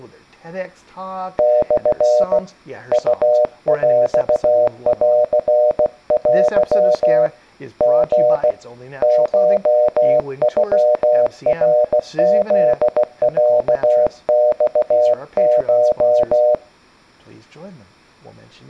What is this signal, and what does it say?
Morse code (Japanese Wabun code), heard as a keyed tone, hand-sent with a paddle, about 16 wpm, 610 Hz, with speech in English. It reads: モ ウヰンテ リ コノナフロマコ